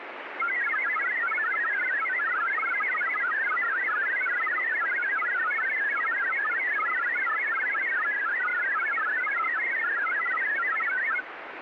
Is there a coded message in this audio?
Yes: multi-tone FSK (Olivia or MFSK type), about 1000 Hz wide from 0.4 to 11.2 s, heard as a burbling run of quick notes, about 62.5 baud, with radio static.